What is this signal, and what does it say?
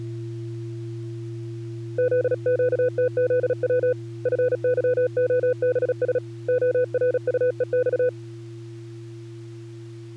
Morse code, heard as a keyed tone, hand-sent with a paddle, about 36 wpm, 500 Hz. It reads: ZQTZW FYOBS ORUEX